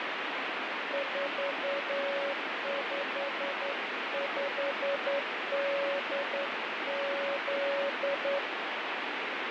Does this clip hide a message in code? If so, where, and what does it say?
Yes: Morse code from 0.9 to 8.4 s, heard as a keyed tone, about 10 wpm, 560 Hz, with heavy radio static. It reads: 455DZ